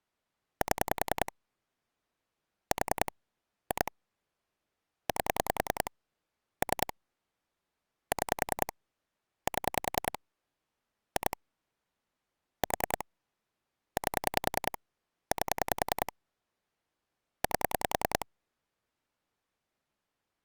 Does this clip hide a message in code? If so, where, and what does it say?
Yes: pulse dialling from 0.6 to 18.2 s, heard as clicks on a phone line, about 10 pulses a second. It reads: 7 4 2 8 3 6 7 2 4 8 8 8